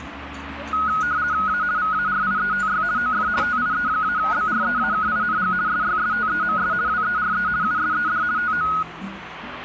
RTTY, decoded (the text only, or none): A VARIETY OF TIE-BREAKING SYSTEMS WERE USED TO